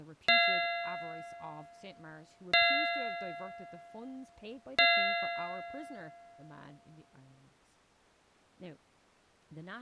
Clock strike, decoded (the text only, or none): 3